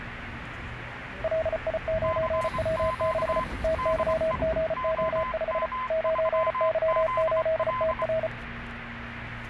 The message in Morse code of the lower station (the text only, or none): LI9W6 TYGO5 9Y8TR